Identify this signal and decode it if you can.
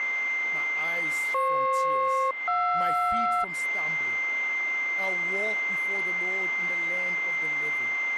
Aircraft SELCAL, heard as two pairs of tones, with a steady whistle near 2090 Hz. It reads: FP-JR